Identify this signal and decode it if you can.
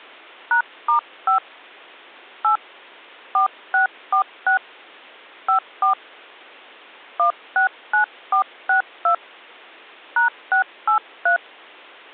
DTMF, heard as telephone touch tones, dialled by hand, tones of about 100 ms. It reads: #*5 8 4646 54 169462 #683